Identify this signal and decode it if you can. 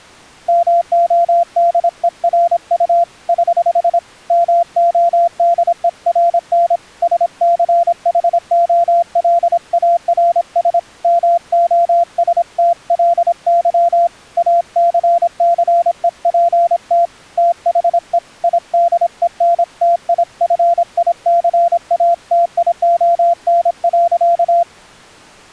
Morse code, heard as a keyed tone, hand-sent with a paddle, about 26 wpm, 690 Hz. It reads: MODERU <HH> MODERN SCHOLARS MOSTLY ACCEPT THE IDENTIFICATION.